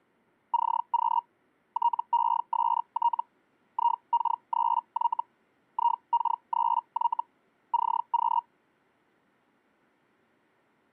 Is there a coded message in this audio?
Yes: Hellschreiber (Feld-Hell, 122.5 baud) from 0.5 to 8.4 s, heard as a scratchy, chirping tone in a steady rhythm, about 940 Hz. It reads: CQ TEST IK3Y IK3Y CQ